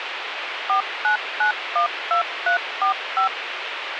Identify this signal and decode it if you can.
DTMF, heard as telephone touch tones, dialled by machine, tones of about 110 ms, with radio hiss. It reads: 49912345